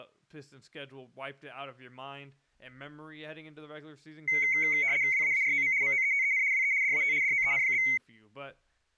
RTTY (75 baud, 170 Hz shift), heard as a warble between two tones, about 2150 Hz centre, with speech in English. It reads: WAAROM MOETEN WE DAT DOEN?